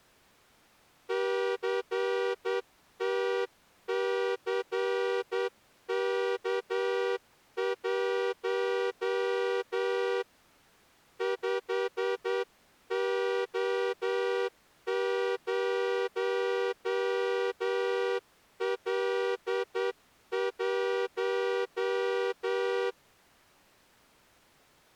Morse code, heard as a horn, hand-sent with a straight key, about 9 wpm. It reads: CTCK1 5O0L1